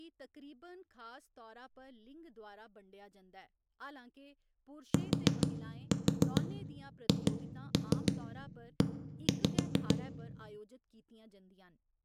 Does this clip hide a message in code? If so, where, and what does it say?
Yes: tap code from 4.9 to 10.0 s, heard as knocks on a wall, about 6 knocks a second, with room echo and speech in Dogri. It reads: THE